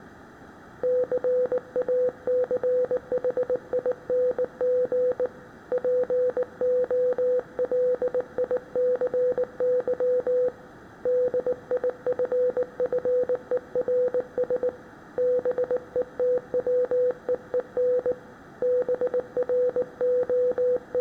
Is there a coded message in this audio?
Yes: Morse code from 0.8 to 21.0 s, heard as a keyed tone, hand-sent with a bug key, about 19 wpm, 500 Hz, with room echo. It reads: CACHING POLICY DIFFERS BETWEEN …